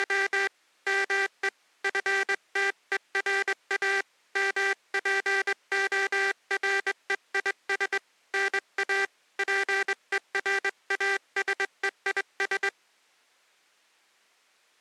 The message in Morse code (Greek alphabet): … ΜΕ ΦΤΕΡΑ ΜΠΟΡΕΙΣ ΝΑ ΠΕΡΑΣΕΙΣ

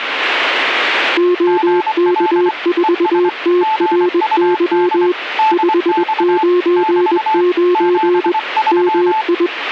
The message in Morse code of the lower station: OK4TRY 599 MI

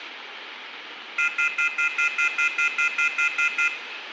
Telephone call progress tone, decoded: off-hook warning tone

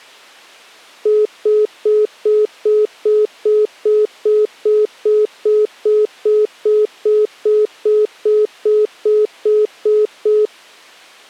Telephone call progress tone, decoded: congestion tone

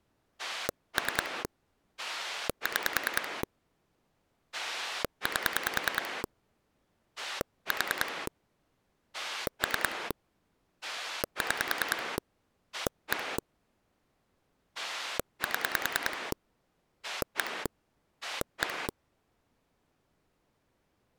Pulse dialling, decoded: 3 6 8 4 3 6 1 7 1 1

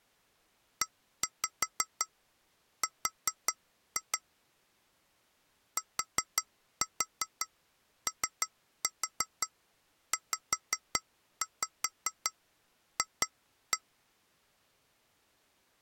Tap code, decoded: ER TOZF

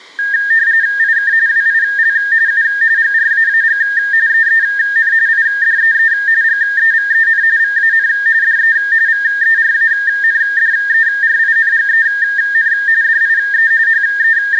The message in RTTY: IK WIL U GRAAG EEN IDEE GEVEN VAN DE VERANDERINGEN DIE …

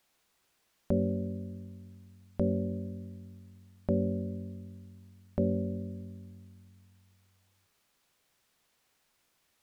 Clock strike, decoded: 4

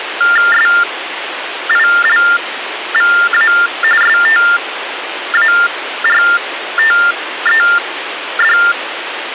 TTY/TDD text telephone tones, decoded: SILVA STARTED

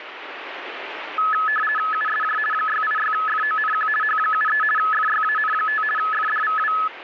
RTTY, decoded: USJ 686FONQ H73 FYAN5 FDVW

